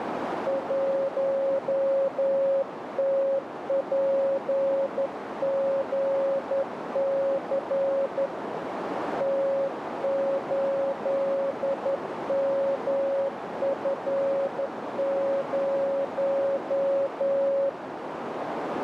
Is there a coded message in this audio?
Yes: Morse code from 0.4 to 17.8 s, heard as a keyed tone, hand-sent with a straight key, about 11 wpm, 550 Hz, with heavy radio static and a narrow filter. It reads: 1TPGC T8MF0